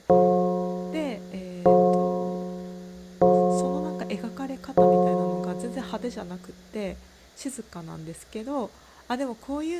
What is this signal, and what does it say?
Clock strike, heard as a bell, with room echo and speech in Japanese. 4. Four o'clock.